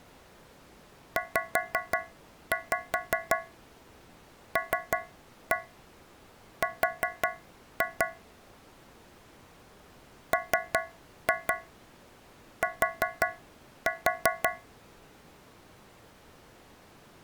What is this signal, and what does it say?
Tap code, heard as taps on a metal pipe, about 5 knocks a second. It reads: ZLR MT